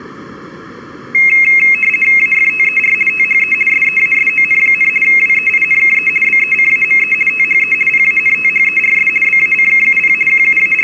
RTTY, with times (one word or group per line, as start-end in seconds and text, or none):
2.2-2.9 AFTER
3.1-3.5 THE
3.7-4.9 SEASON,
5.0-6.1 WEINKE
6.2-7.1 BECAME
7.3-7.7 THE
7.9-9.1 PANTHERS
9.2-10.1 BACKUP
10.3-10.8 …